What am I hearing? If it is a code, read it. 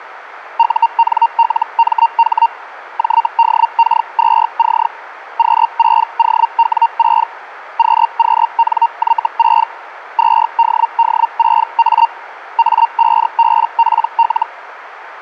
Hellschreiber (Feld-Hell, 122.5 baud), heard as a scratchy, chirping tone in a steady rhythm, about 920 Hz, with radio static. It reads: UNLMH JDK2C Q6OW6 QQNY6 2DD6A A5BPL